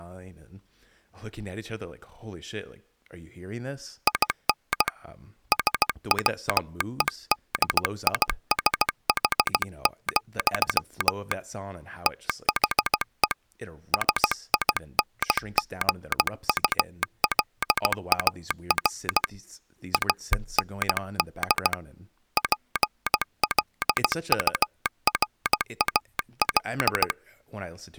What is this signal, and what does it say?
Morse code, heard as a telegraph sounder, hand-sent with a paddle, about 16 wpm, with speech in English. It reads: IN SWEDISH, THE SINGULAR AND PLURAL